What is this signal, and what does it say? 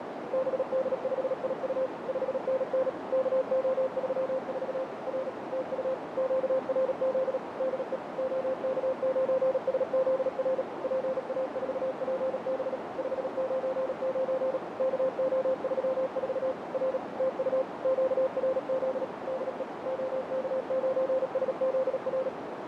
Morse code, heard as a keyed tone, machine-sent, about 37 wpm, 520 Hz, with heavy radio static and a narrow filter. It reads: BD5IU 5NN KO34 R TU QRZ DE OK9SZR PA4PB 599 KO34 R TU QRZ DE OK9SZR